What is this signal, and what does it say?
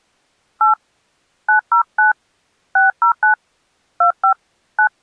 DTMF, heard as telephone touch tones, dialled by hand, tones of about 120 ms. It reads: 8 909 609 25 9